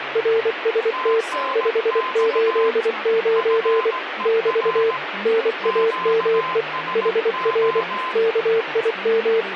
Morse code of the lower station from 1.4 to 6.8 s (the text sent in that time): 589 <BT> NAME